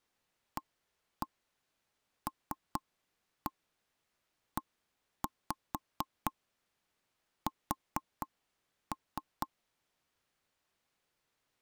Tap code, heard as knocks on wood, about 4 knocks a second. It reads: ALES